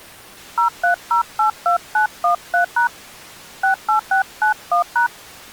DTMF, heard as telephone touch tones, dialled by hand, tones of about 110 ms. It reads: 03082913# 68691#